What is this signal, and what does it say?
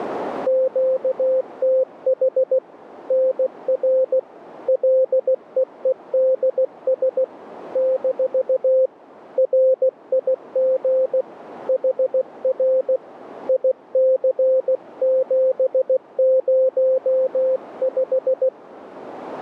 Morse code, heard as a keyed tone, hand-sent with a paddle, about 16 wpm, 520 Hz, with radio static. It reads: QTH NR LEEDS - RIG HR IC705